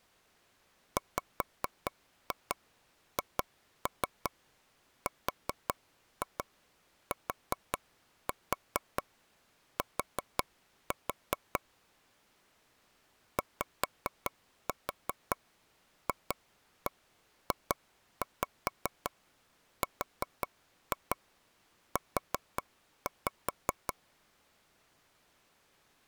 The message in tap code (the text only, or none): WHRTT YFJRU